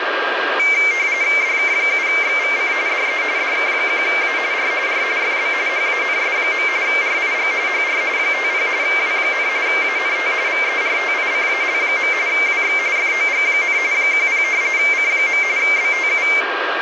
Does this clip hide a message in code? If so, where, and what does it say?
Yes: RTTY (45.45 baud, 170 Hz shift) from 0.6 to 16.4 s, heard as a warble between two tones, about 2200 Hz centre, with radio static, a steady whistle near 1610 Hz and room echo. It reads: DK7XVC DE DK1A R R FB HANS. RIG HR 50 W, ANT VERTICAL. WX FOG, 10 C. BTU